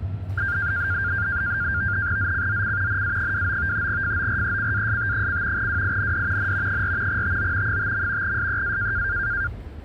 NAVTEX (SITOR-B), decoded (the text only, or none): ZCZC NA29 FORECAST: WIND N 4 TO 5. SEA